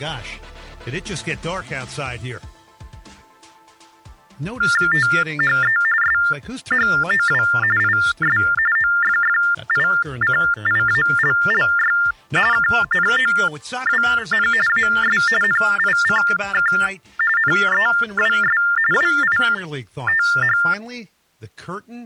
TTY/TDD text telephone tones (45.45 baud Baudot), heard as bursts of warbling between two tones, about 400 Hz shift, 1600 Hz centre. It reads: THE SHOW IS OFFICIALLY KNOWN AS NICK NEWS WITH